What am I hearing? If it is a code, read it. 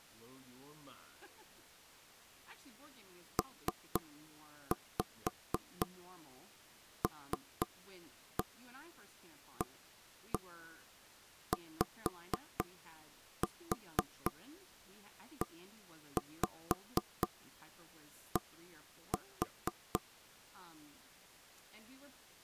Tap code, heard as taps on a table, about 4 knocks a second, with speech in English. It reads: PLAYED